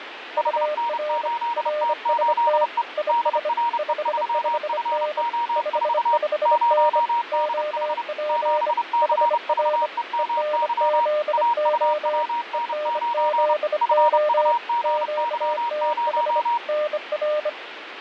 Morse code, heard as two keyed tones, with radio static. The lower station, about 25 wpm, 600 Hz: UR RST IS 55N 55N OP HR ENZO ENZO QTH NR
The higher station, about 30 wpm, 940 Hz: HN8T8E DRE3FO4 0DH 7CVEMY AUWN9 FUGY0